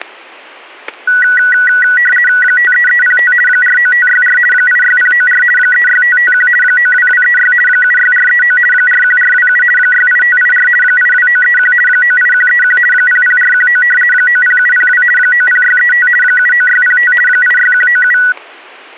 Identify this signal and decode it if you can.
RTTY (50 baud, 450 Hz shift), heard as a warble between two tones, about 1700 Hz centre, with static crashes. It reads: 53305 49564 86094 36551 92236 76439 41427 68584 82931 98131 00419 90702 90635 79605 86197